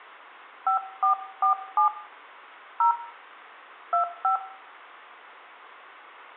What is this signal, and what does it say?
DTMF, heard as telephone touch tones, dialled by hand, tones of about 110 ms, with room echo. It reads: 5447 0 25